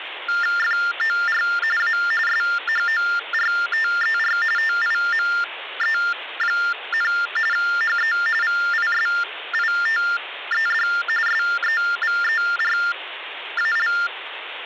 TTY/TDD text telephone tones (45.45 baud Baudot), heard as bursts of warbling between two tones, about 400 Hz shift, 1600 Hz centre, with phone line noise. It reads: FOR A SHORTER TIME, HE VISITED SEVERAL